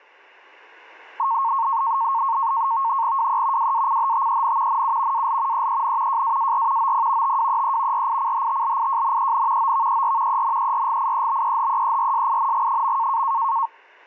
NAVTEX (SITOR-B), 100 baud, 170 Hz shift, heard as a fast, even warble, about 1000 Hz centre. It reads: WE WACHTEN NU AL EEN JAAR OP TWEE RICHTLIJNEN OVER ENERGIEBEHEERSING.